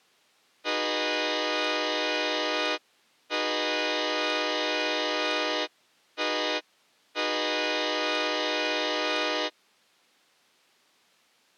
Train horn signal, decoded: 2 long, 1 short, 1 long

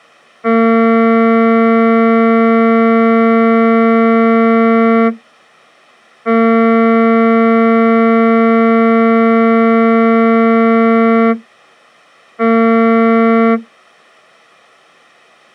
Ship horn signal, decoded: 2 long, 1 short

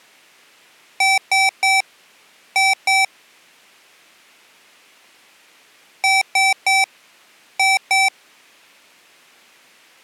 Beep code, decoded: 3-2

